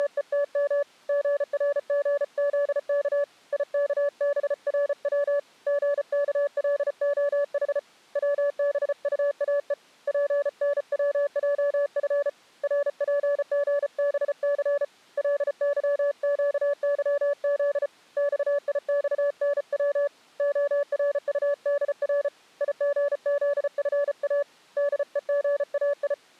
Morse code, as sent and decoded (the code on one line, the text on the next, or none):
… / --. .-. --. --.. -.- / .. -.- -... .-. .-- / --. -.- .-.. --- .... / .-- -... ..- .- . / .--. -. .-- .--- ..-. / .-. .--. --. -... -.-. / .-.. -.-- --.- -.-- --.. / -..- .. -..- -. .-- / --- .-. ..- -.. .-. / .. --. --.. ..-. .- / -.. . --. .- ..
… GRGZK IKBRW GKLOH WBUAE PNWJF RPGBC LYQYZ XIXNW ORUDR IGZFA DEGAI